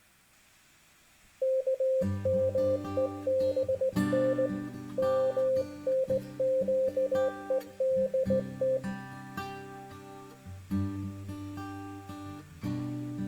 Morse code (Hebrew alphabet), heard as a keyed tone, hand-sent with a straight key, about 18 wpm, 520 Hz, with room echo. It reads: כמובן מנקודת